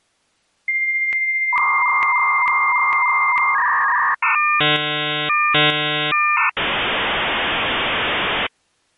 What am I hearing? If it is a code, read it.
Dial-up modem handshake (V.34 or later), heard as a whistle, warbles, then hiss.